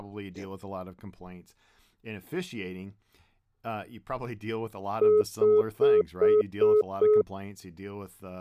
Telephone call progress tone (single-tone plan, as in most of Europe), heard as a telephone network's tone, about 420 Hz, 0.2 s on and 0.2 s off, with speech in English. Congestion tone.